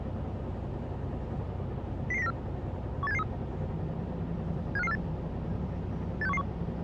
Five-tone selective call (EEA), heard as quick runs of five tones, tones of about 40 ms, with the noise inside a bus. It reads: 00094 18773 75548 86111